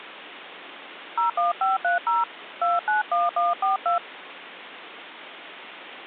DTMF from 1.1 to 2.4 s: 01530

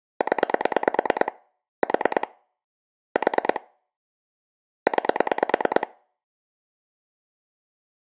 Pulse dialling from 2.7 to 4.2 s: 4

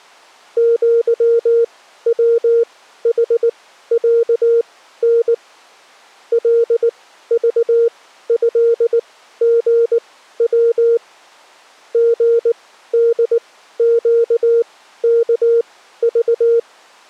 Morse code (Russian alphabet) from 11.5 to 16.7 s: ГДЩКЖ

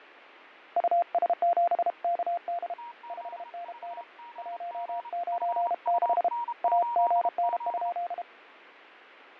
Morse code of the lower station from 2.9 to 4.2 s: 5NN

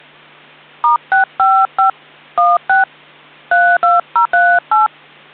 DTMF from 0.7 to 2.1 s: *655

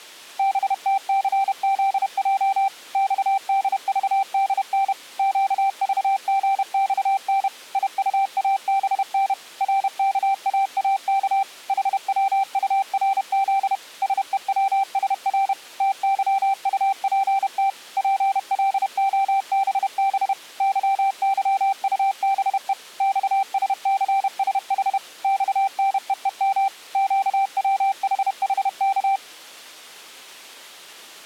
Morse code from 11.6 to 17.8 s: HWURZ SEWSR TYUPT

